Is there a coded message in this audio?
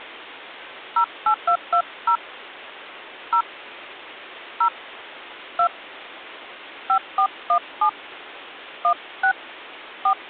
Yes: DTMF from 1.0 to 10.1 s, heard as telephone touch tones, dialled by hand, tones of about 80 ms. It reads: 08220 0 0 2 5417 16 4